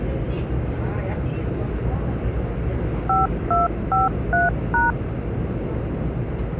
DTMF, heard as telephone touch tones, dialled by machine, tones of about 160 ms, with the noise inside a subway train. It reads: 5253#